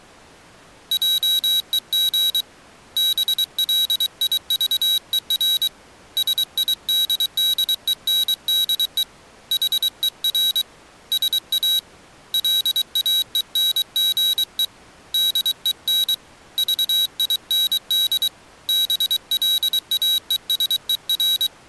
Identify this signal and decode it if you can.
Morse code, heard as a high beeper, hand-sent with a paddle, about 23 wpm, 3850 Hz. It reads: JEG BLIVER SIDDENDE HER SA LAENGE DEN VIND BLAESER